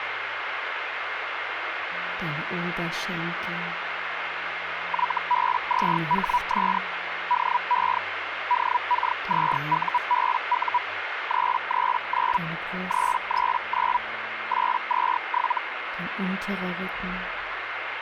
Hellschreiber (Feld-Hell, 122.5 baud), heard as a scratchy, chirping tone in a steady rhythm, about 980 Hz, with radio static. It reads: YB2HS DE DK2UBU 339 339 827